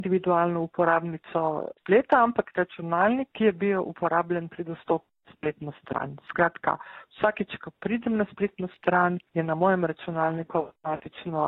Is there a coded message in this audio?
No.